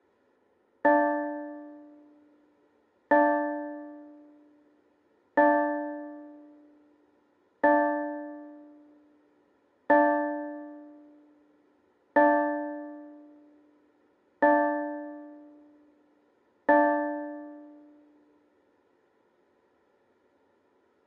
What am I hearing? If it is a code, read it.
Clock strike, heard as a bell, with room echo. 8. Eight o'clock.